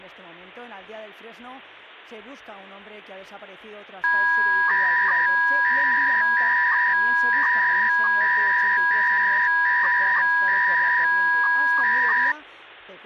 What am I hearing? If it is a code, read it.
300-baud modem data (V.21 tones), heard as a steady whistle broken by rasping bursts, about 300 baud, 200 Hz shift.